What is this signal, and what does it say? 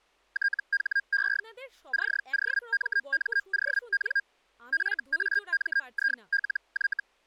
Hellschreiber (Feld-Hell, 122.5 baud), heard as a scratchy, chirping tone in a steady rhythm, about 1600 Hz, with speech in Bangla. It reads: THE COMMON FAMILY